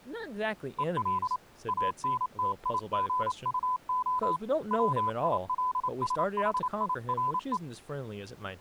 Morse code, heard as a keyed tone, hand-sent with a paddle, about 28 wpm, 1010 Hz, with speech in English. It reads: EL ANTIGUO WILSHIRE